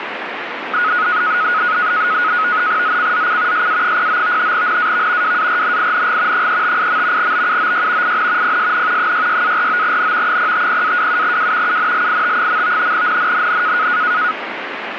NAVTEX (SITOR-B), 100 baud, 170 Hz shift, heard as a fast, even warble, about 1360 Hz centre, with radio static. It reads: ZCZC SA09 NAV WARNING 358. BUOY IN PSN 66-49N 050-27W UNLIT. NNNN